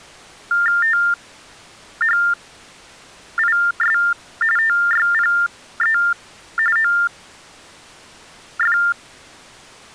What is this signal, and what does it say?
TTY/TDD text telephone tones (45.45 baud Baudot), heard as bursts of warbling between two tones, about 400 Hz shift, 1600 Hz centre. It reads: THIS TYPE OF